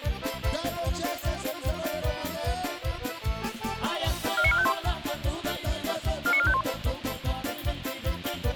Five-tone selective call (ZVEI), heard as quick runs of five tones, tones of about 70 ms, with a squelch burst at the end. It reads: 49451 49451